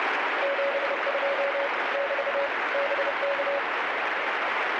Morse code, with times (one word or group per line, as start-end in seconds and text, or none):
0.4-1.7 72
1.9-2.5 <BT>
2.7-3.6 BK